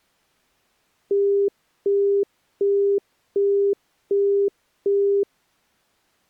Telephone call progress tone (as in the UK, Australia and similar networks), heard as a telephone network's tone, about 400 Hz, 0.375 s on and 0.375 s off. Busy tone.